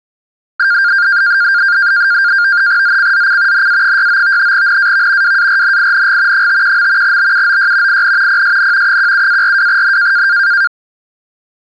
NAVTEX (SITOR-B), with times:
2.8-3.7 ZCZC
3.5-4.5 NA69
4.5-5.4 NAV
5.2-6.5 WARNING
6.3-7.2 51.
7.0-8.0 BUOY
7.9-8.4 IN
8.3-9.0 PSN
8.9-10.3 17-42N

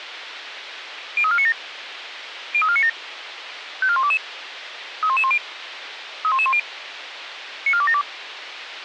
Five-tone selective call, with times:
1.2-1.5 03497
2.5-2.9 03497
3.8-4.2 54122
5.0-5.4 31110
6.2-6.6 31110
7.7-8.0 94272

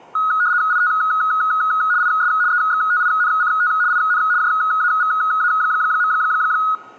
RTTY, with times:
0.7-0.9 IT
2.0-2.3 IS
2.5-3.7 EXTINCT
3.9-4.2 IN
4.4-6.1 JAVA.

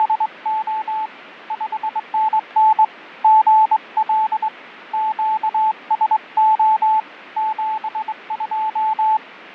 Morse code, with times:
0.0-1.1 …
1.5-2.8 5NN
3.2-4.5 GL
4.9-7.0 QSO
7.4-9.2 72

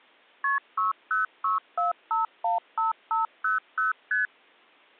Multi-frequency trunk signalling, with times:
0.4-0.6 KP
0.8-3.9 6064515500
4.1-4.3 ST

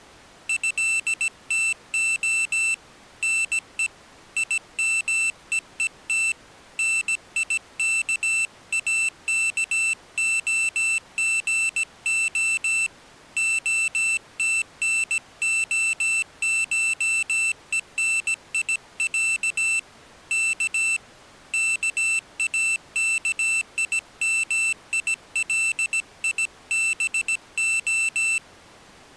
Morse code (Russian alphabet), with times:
0.5-2.7 ЭТО
3.2-3.9 НЕ
4.4-6.3 ИМЕЕТ
6.8-12.9 НИКАКОГО
13.4-19.8 ОТНОШЕНИЯ
20.3-21.0 К
21.5-28.4 КАКИМИЛИБО

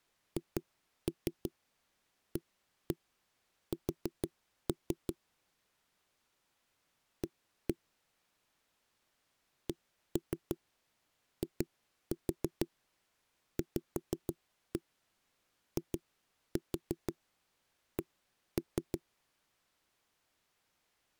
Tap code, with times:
0.4-5.1 HAS
7.2-7.7 A
9.7-19.0 CIVIC

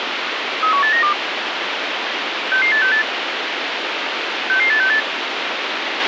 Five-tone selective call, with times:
0.6-1.1 31892
2.5-3.0 66868
4.5-5.0 66868

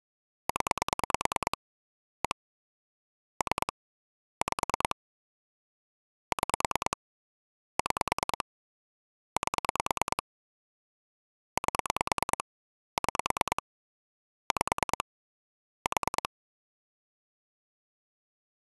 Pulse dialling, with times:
0.5-1.6 0
2.2-2.4 1
3.4-3.7 3
4.4-5.0 5
6.3-7.0 6
7.8-8.4 6
9.4-10.2 8
11.6-12.4 8
13.0-13.6 6
14.5-15.0 5
15.9-16.3 4

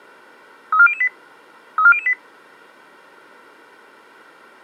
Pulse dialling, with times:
none

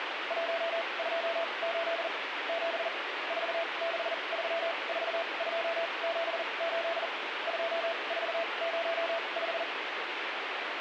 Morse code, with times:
0.3-2.1 128
2.5-2.9 7
3.3-7.1 4634278
7.5-9.6 2405

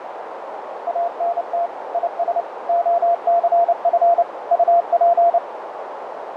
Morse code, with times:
0.9-1.7 ANT
1.9-2.4 IS
2.7-4.2 OCF
4.5-5.4 UP

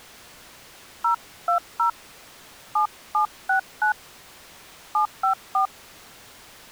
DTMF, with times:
1.0-1.9 020
2.8-3.9 7769
4.9-5.7 754

